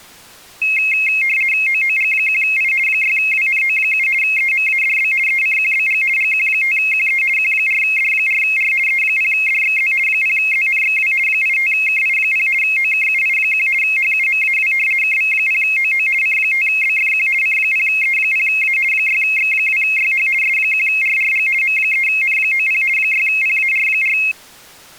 RTTY (50 baud, 450 Hz shift), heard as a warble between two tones, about 2350 Hz centre. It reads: OOG1I 6WNO7 EMADB ECQBG GQ5QE Q4D4R E0DXZ 0ZNXW 85KI0 OKUI1 HUMAW KV0OO C5BFQ C0E0A 6X2YH S1RRG M3N90 6PAR4